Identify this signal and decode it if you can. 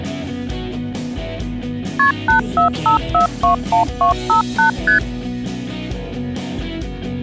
Multi-frequency trunk signalling (R1, as on North American trunks), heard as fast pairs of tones, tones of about 120 ms. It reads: KP 845421258 ST